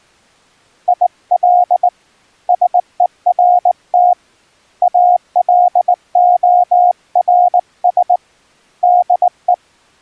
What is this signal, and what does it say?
Morse code, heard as a keyed tone, hand-sent with a straight key, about 19 wpm, 720 Hz. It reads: IL SERT ALORS DE